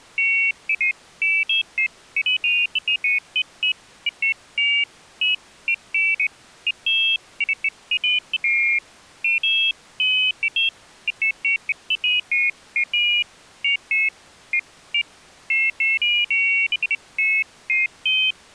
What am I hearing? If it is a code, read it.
Pairs of high tones at irregular times. There is no code.